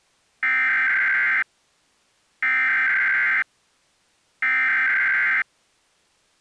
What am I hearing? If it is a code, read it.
Emergency Alert System (SAME) tones (header bursts), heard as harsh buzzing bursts, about 520.83 baud.